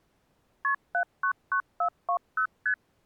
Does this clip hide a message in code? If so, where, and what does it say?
Yes: multi-frequency trunk signalling (R1, as on North American trunks) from 0.6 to 2.7 s, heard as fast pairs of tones, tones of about 80 ms. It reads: KP 799420 ST